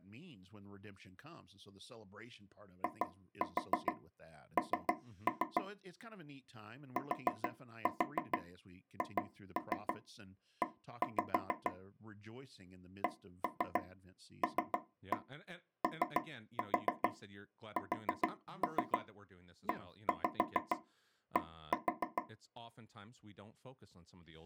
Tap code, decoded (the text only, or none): IN THE CLOSED